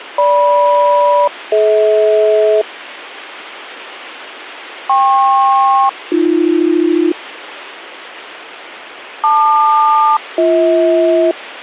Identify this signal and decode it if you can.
Aircraft SELCAL, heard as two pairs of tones, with radio hiss. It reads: GM-DH KP-AB LQ-BH